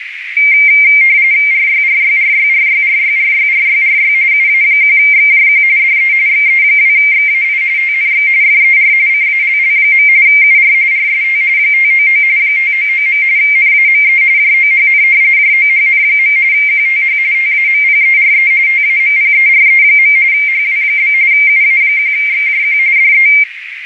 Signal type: RTTY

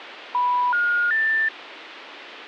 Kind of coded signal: telephone call progress tone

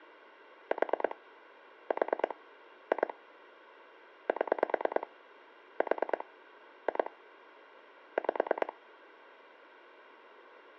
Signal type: pulse dialling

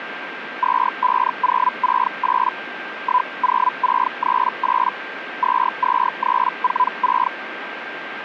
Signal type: Hellschreiber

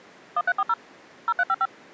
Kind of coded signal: DTMF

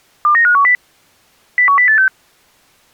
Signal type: five-tone selective call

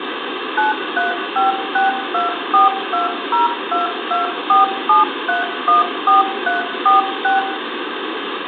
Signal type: DTMF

